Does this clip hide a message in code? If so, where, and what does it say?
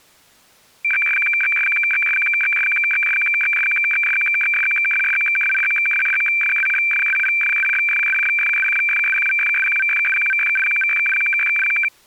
Yes: weather fax (radiofax), 120 lines a minute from 0.8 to 11.9 s, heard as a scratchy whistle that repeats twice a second.